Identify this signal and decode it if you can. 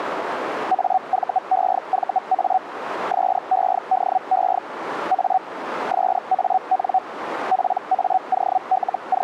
Hellschreiber (Feld-Hell, 122.5 baud), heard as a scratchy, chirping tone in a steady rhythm, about 750 Hz, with radio static. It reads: AVEVA SEDE A SAN …